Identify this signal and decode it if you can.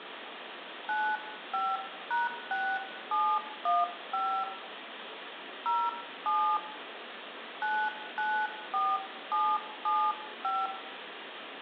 DTMF, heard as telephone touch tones, dialled by hand, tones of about 240 ms, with phone line noise and room echo. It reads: 95#6715 07 994775